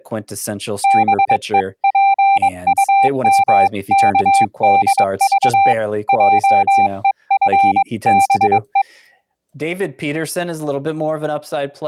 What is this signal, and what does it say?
Morse code (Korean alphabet), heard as a keyed tone, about 22 wpm, 790 Hz, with speech in English. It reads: 다짐을 한다